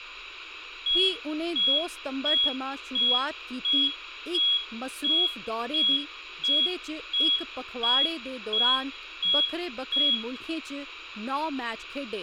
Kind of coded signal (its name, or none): none